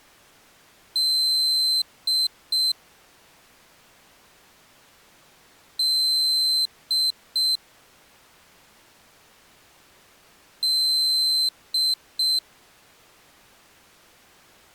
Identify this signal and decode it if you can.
Beep code, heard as a piezo beeper, played three times, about 4100 Hz. 1 long, 2 short. In Award, IBM and AMI BIOS tables: video adapter failure.